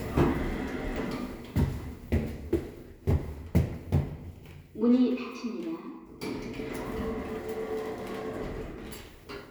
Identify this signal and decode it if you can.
The noise inside a lift. There is no code.